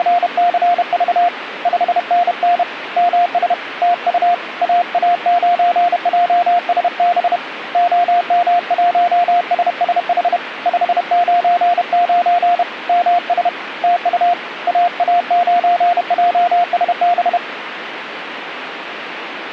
Morse code, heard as a keyed tone, hand-sent with a paddle, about 31 wpm, 700 Hz, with radio static. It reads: … 5NN MS TU AA9JSB OM1SSH 599 MS TU AA9JSB